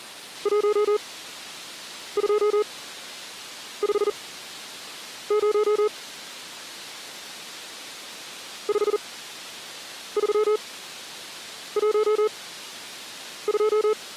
Morse code, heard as a keyed tone, machine-sent, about 40 wpm, spaced as for 7 wpm, 430 Hz. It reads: 1250 5312